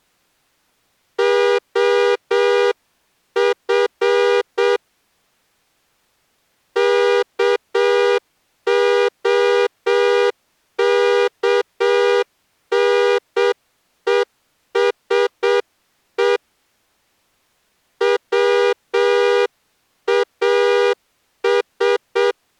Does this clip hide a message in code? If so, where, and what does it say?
Yes: Morse code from 1.1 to 22.4 s, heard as a horn, hand-sent with a straight key, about 7 wpm. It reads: OF KOKNESE WAS